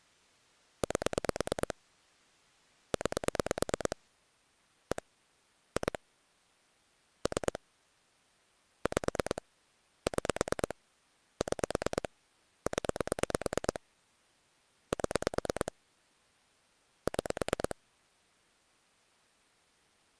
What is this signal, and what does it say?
Pulse dialling, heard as clicks on a phone line, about 9 pulses a second. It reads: 8 9 1 2 3 5 6 6 0 7 6